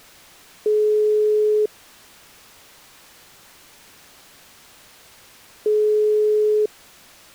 Telephone call progress tone (single-tone plan, as in most of Europe), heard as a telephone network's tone, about 420 Hz, 1 s on and 4 s off. Ringback tone.